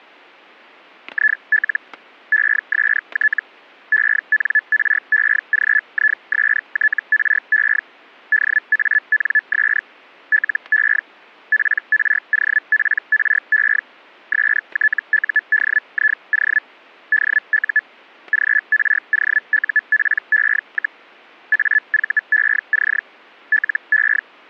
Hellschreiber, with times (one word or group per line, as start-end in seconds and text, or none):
1.1-1.8 IL
2.3-3.4 EST
3.9-7.8 ENREGISTRE
8.3-9.8 DANS
10.3-11.0 LE
11.5-13.8 PROPRE
14.3-16.6 STUDIO
17.1-17.8 DU
18.3-21.0 GROUPE,
21.5-23.0 AVEC
23.5-24.2 LE